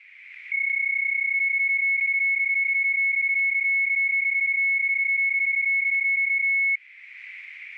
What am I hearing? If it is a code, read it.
PSK31 (31.25 baud), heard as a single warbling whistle, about 2200 Hz, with static crashes.